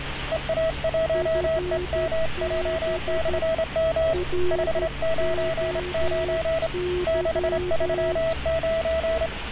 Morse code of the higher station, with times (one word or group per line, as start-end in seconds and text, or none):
0.3-4.1 EA1EMJ/M
4.5-6.7 599
7.1-9.3 639